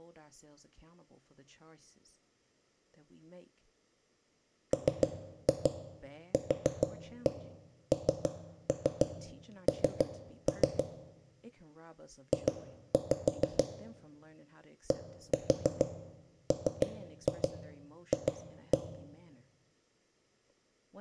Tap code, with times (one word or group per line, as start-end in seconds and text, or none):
4.7-10.8 MQNN
12.3-13.6 J
14.9-18.8 DMF